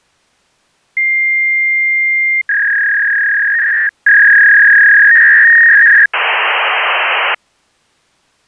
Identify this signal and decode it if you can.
Fax machine handshake, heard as a long tone, a warble and hiss.